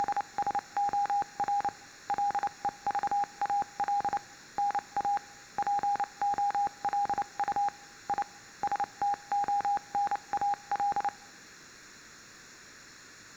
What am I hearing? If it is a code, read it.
Morse code (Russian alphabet), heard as a keyed tone, machine-sent, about 29 wpm, spaced as for 25 wpm, 810 Hz. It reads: … ЛЕЖАЛ НА ПОЛУ И СТОНАЛ